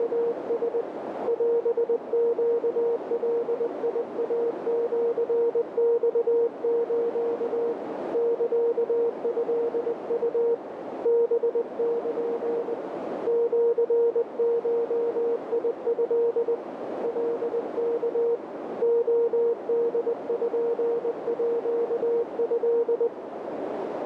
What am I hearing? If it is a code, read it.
Morse code (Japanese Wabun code), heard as a keyed tone, hand-sent with a paddle, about 20 wpm, 470 Hz, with heavy radio static and a narrow filter. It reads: … オネガイシマス サトウ ハル シゴト カワ レポート